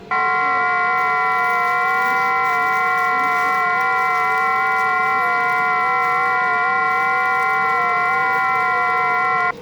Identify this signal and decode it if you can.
FT8 (several signals at once), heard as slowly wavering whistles, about 6.25 baud, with the noise inside a subway train.